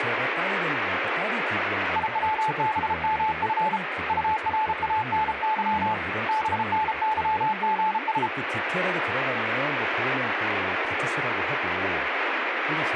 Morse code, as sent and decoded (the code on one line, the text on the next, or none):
.. .-- -... -- ..-. / ..- .-. .- -. -.-- / -... -. -.-- --. ...
IWBMF URANY BNYGS